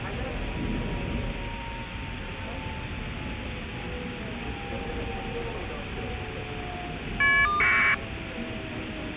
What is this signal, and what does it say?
Caller ID data burst, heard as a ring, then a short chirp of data, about 1200 baud, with phone line noise and the noise inside a subway train.